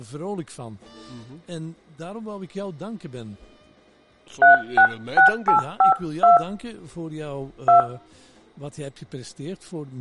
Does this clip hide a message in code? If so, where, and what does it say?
Yes: DTMF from 4.4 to 7.8 s, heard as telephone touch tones, dialled by hand, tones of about 110 ms, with room echo. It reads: 366852 2